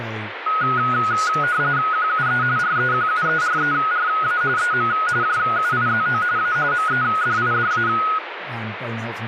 RTTY (45.45 baud, 170 Hz shift), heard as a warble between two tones, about 1360 Hz centre, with radio static and speech in English. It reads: QUE REQUERERA EM JUIZO A MEDIDA